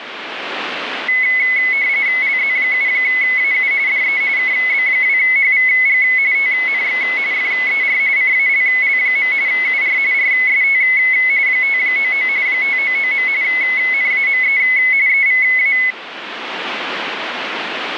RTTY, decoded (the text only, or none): LZ7AU DE KB2HVG TNX FER CALL. UR RST 599 599. NAME EVA